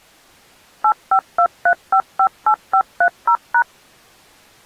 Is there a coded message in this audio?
Yes: DTMF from 0.8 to 3.6 s, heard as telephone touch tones, dialled by machine, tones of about 80 ms. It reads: 8523558530#